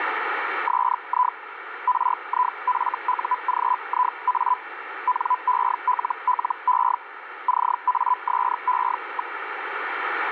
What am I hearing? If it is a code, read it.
Hellschreiber (Feld-Hell, 122.5 baud), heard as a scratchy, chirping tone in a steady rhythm, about 1000 Hz, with radio static. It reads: SI RIFUGIA NELLE CASE.